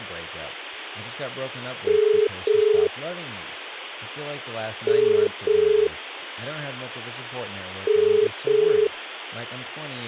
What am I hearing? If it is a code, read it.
Telephone call progress tone (as in the UK, Ireland, Australia and similar networks), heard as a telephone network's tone, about 430 Hz, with phone line noise and speech in English. Ringback tone.